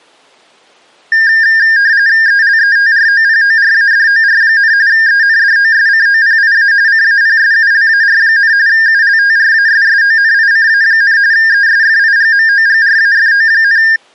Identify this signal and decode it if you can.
RTTY (45.45 baud, 170 Hz shift), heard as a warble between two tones, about 1700 Hz centre. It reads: ELETROPORADOR, ENDOSCOPIA CAPSULAR, ULTRASSONICA, ESFIGMOGRAFO,